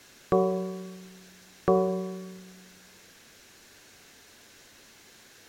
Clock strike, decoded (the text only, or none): 2